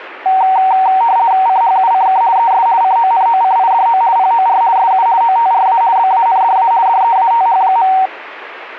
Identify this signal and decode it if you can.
RTTY (50 baud, 170 Hz shift), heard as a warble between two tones, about 840 Hz centre. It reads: CHUCK ES CONOCIDO POR SU OTRA BANDA DEATH.